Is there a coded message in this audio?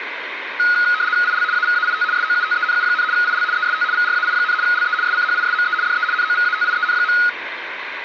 Yes: RTTY (75 baud, 170 Hz shift) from 0.6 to 7.3 s, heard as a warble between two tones, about 1360 Hz centre, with radio static and room echo. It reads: IL AVAIT SOUTENU, IL EST VRAI, LE SCHISME DE NOVATIEN.